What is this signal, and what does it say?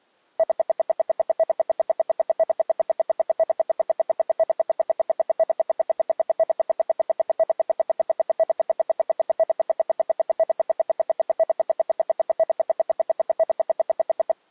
Radio time signal (RWM, Moscow), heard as ten pulses a second.